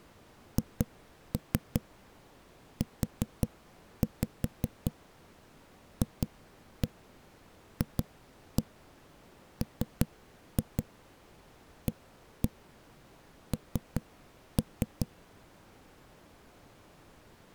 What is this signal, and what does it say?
Tap code, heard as knocks on a wall, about 5 knocks a second. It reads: HUFFMAN